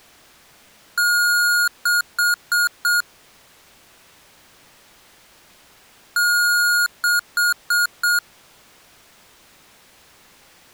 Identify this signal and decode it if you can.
Beep code, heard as beeps from a small speaker, played twice, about 1430 Hz. 1 long, 4 short.